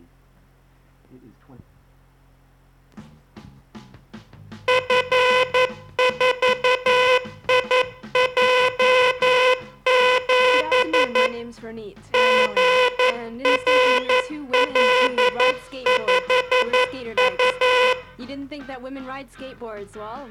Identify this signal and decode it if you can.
Morse code, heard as a buzzer, hand-sent with a paddle, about 11 wpm. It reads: F4IJ7 GRL5U